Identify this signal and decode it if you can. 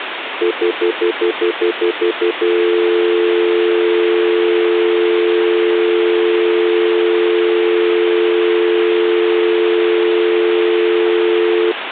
Telephone call progress tone (North American plan), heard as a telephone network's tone, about 350, 440 Hz, 0.1 s on and 0.1 s off, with phone line noise. Stutter dial tone.